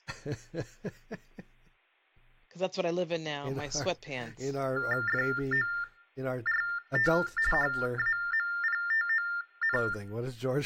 TTY/TDD text telephone tones (45.45 baud Baudot), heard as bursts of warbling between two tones, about 400 Hz shift, 1600 Hz centre, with room echo and speech in English. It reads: FORT HAMPTON